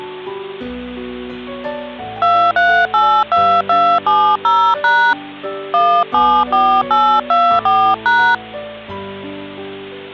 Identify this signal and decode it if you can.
DTMF, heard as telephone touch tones, dialled by hand, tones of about 290 ms, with hum. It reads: 2382270# 174824#